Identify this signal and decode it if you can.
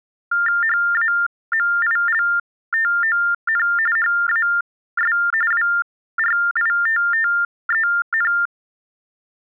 TTY/TDD text telephone tones (45.45 baud Baudot), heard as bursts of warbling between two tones, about 400 Hz shift, 1600 Hz centre. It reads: HAMILTON HAS WRITTEN